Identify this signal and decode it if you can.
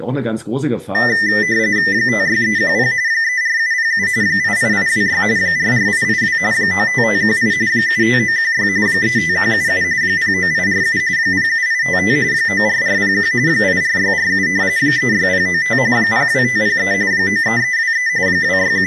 RTTY (45.45 baud, 170 Hz shift), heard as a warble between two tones, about 1900 Hz centre, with speech in German. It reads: 56310 34707 88826 44882 95518 75916 35177 09847 07855 94401 84647 36095 02503 93323 …